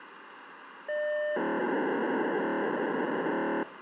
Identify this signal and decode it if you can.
POCSAG pager data (1200 baud), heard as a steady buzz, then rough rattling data, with radio hiss.